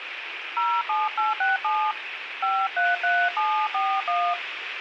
DTMF, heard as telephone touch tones, dialled by hand, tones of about 230 ms, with radio hiss. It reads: 07867 533741